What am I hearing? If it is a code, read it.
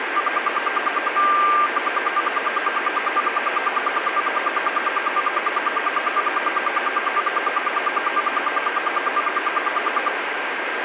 Radio time signal (RWM, Moscow), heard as ten pulses a second, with radio static and a steady whistle near 1590 Hz.